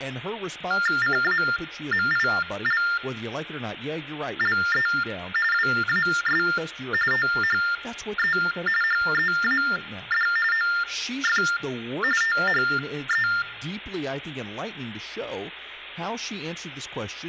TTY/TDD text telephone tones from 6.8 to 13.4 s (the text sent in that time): THE HEAD OF THE